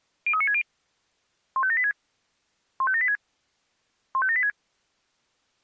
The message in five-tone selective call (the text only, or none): 03960 15786 15786 15786